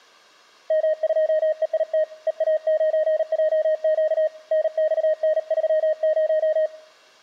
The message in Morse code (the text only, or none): M2EIT EA9JQ NXN30